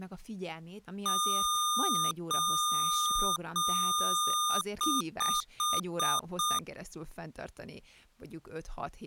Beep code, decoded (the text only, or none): 3 long, 5 short